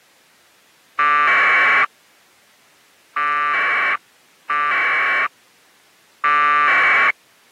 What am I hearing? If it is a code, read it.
Packet radio (AX.25, as in APRS), 1200 baud, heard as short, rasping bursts.